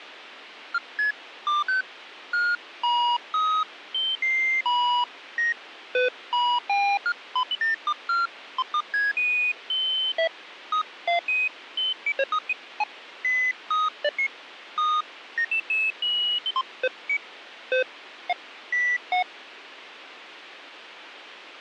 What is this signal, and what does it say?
Electronic bleeps of random pitch and length, with radio hiss. There is no code.